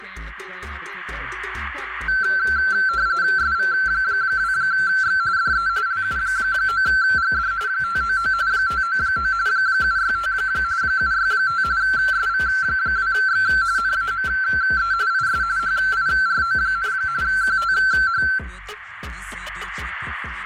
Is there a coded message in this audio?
Yes: RTTY (45.45 baud, 170 Hz shift) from 2.1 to 18.4 s, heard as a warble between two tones, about 1450 Hz centre, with radio static. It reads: SV2X DE LU9GD 599 599 765 765 SV2X NAME IS HIRO, QTH